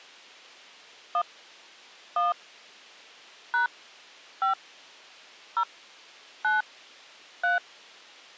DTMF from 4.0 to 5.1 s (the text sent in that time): 5